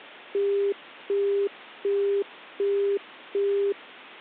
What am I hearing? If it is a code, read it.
Telephone call progress tone (as in the UK, Australia and similar networks), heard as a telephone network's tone, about 400 Hz, 0.375 s on and 0.375 s off. Busy tone.